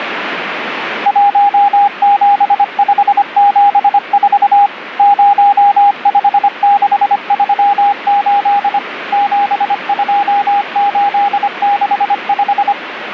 Morse code, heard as a keyed tone, machine-sent, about 25 wpm, 810 Hz, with radio static. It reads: 17574 05638 72865